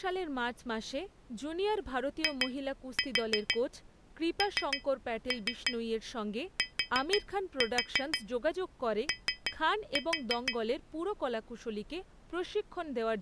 Tap code, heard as taps on glass, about 6 knocks a second, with speech in Bangla. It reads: INTO